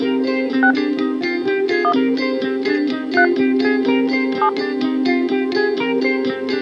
DTMF, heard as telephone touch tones, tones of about 80 ms. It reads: 6 1 3 7